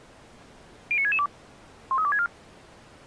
Five-tone selective call (ZVEI), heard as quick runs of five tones, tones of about 70 ms. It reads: 09662 13264